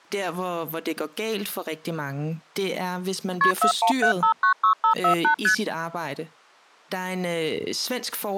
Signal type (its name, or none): multi-frequency trunk signalling